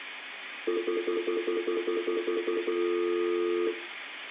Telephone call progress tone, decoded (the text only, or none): stutter dial tone